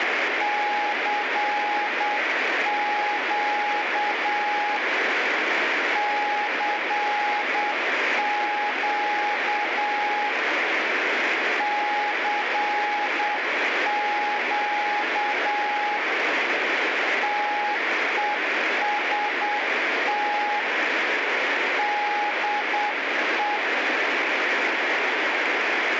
Morse code, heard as a keyed tone, hand-sent with a paddle, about 8 wpm, 830 Hz, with radio static. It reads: CQ CQ CQ TEST DE